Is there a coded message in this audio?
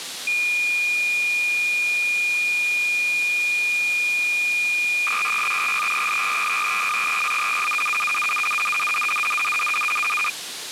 Yes: cassette data (Kansas City type), 300 baud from 0.3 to 10.3 s, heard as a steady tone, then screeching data, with tape hiss.